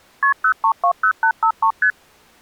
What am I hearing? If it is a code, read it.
Multi-frequency trunk signalling (R1, as on North American trunks), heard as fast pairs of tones, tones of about 80 ms. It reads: KP 0320853 ST